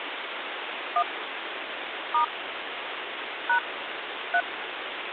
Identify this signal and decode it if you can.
DTMF, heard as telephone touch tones, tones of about 80 ms, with phone line noise. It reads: 1 * # 3